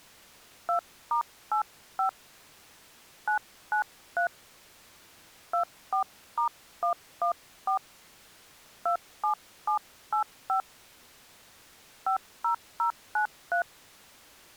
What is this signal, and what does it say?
DTMF, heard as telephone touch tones, dialled by hand, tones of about 100 ms. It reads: 2*85 993 24*114 27785 50093